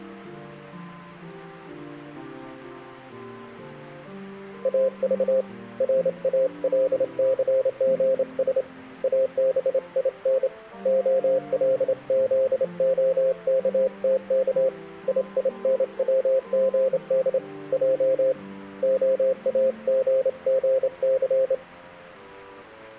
Morse code, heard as a keyed tone, hand-sent with a straight key, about 28 wpm, 530 Hz. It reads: AV RALCGS ABIN OLZOKTK IINWGD J OAGGC